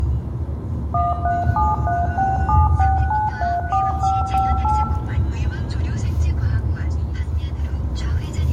DTMF, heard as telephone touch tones, dialled by machine, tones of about 190 ms, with room echo and the noise inside a car. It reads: 1373676934558